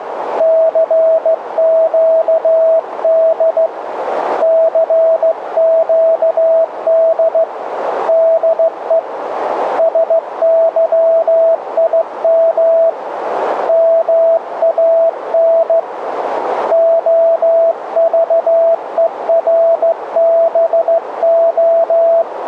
Morse code, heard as a keyed tone, hand-sent with a straight key, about 15 wpm, 660 Hz, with radio static and a narrow filter. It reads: CQD CQD DE SYIM MAN …